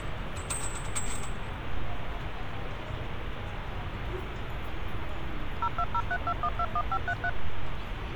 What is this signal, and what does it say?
DTMF, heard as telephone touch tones, dialled by machine, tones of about 60 ms, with phone line noise and street noise. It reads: 02032121533